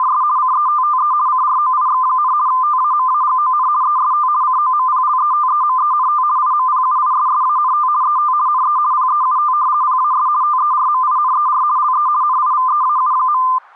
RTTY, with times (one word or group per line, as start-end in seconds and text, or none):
0.0-0.2 …
0.4-1.1 CETTE
1.3-2.3 CROIX,
2.5-3.7 TAMAGON
3.8-4.3 EST
4.4-6.2 COMPLETEMENT
6.4-7.9 IMPUISSANT
8.0-8.3 ET
8.5-8.8 NE
8.9-9.5 PEUT
9.8-10.3 PAS
10.4-11.6 TERMINER
11.8-12.1 LE
12.2-13.4 NIVEAU.